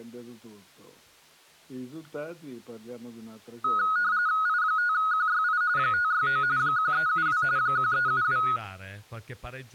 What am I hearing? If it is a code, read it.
RTTY (45.45 baud, 170 Hz shift), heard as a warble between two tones, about 1360 Hz centre. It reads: I5QYI 569 1372 1372